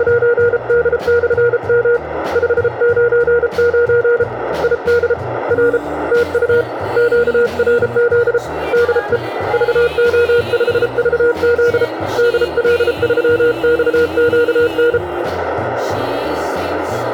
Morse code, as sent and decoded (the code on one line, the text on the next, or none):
… / ..... ----. ----. / .. -.. / .-. / - ..- / --.- .-. --.. / -.. . / ...- --- ..... ...- --.. / -.. .-.. ...-- -..- --.- -.
… 599 ID R TU QRZ DE VO5VZ DL3XQN